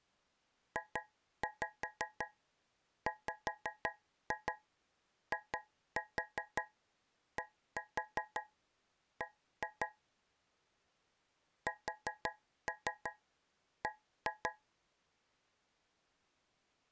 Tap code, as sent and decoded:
2-5 5-2 2-4 1-4 1-2 / 4-3 1-2
JWIDB SB

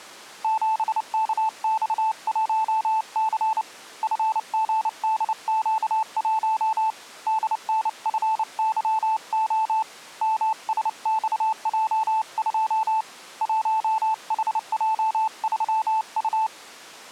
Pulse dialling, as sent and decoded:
none

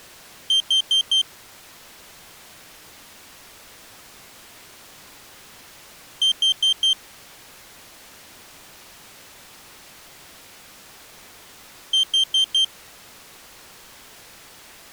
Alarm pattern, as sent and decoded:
4 beeps and a pause
temporal four

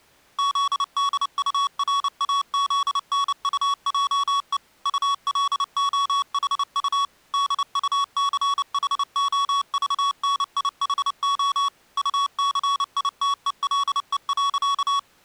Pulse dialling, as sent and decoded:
none

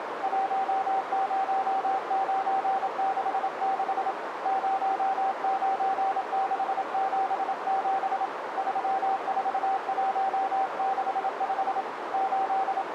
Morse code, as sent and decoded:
.---- ----- ----. -.... -.... / ----- ----. -.... --... --... / ...-- ....- .---- -.... ..... / …
10966 09677 34165 …

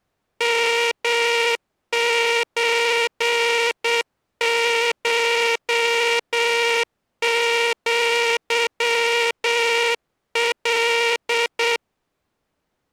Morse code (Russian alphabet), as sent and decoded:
-- ---. ---- --.-- .-..
МЧШЪЛ

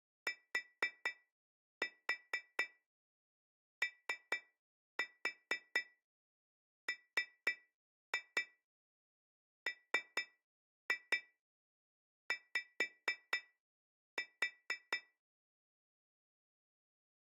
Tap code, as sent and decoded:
4-4 3-4 3-2 3-2 5-4
TOMMY

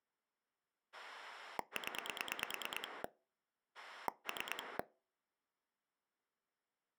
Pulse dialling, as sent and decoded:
10 / 3
0 3

